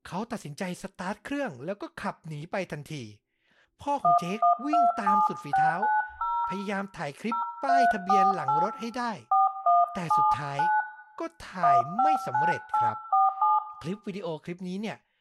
DTMF, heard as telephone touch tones, dialled by hand, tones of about 180 ms, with room echo and speech in Thai. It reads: 1127690 0348 4179 159847